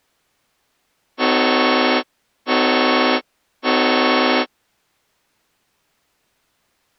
Train horn signal, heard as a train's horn. 3 short. On North American railways: when stopped, the train will back up.